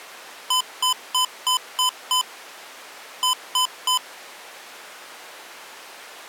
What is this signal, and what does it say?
Beep code, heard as beeps from a small speaker, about 1010 Hz. 6-3.